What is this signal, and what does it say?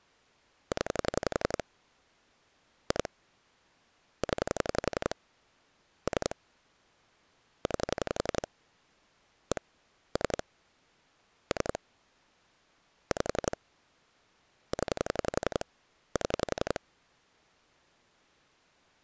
Pulse dialling, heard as clicks on a phone line, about 11 pulses a second. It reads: 0 2 0 3 9 1 3 3 5 0 7